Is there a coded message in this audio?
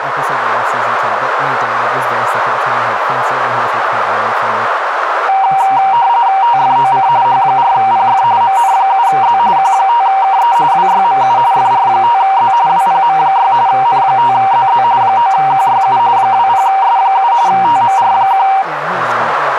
Yes: RTTY (45.45 baud, 170 Hz shift) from 5.3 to 18.6 s, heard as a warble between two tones, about 860 Hz centre, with radio static, a narrow filter and speech in English. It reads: TFOC H4PF MN7Z Q5KE WYMU FR5Z WPM6 N5ZZ 9QYU 20S7 TMR1